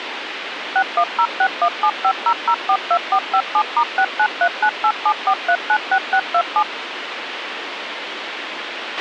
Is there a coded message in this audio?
Yes: DTMF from 0.8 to 6.6 s, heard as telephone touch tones, dialled by machine, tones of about 70 ms, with radio hiss and a squelch burst at the end. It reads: 61061750042457*6939874396627